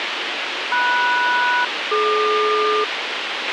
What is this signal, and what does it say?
Aircraft SELCAL, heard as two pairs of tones, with radio hiss and a squelch burst at the end. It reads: MS-DQ